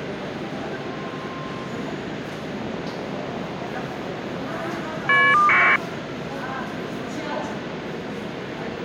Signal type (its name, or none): caller ID data burst